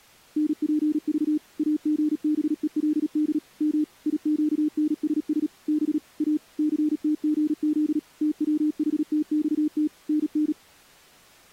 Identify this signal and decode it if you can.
Morse code, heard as a keyed tone, machine-sent, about 37 wpm, 300 Hz. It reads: NPV AGBELD M IQNSS B A CTGZ TWHTXT NN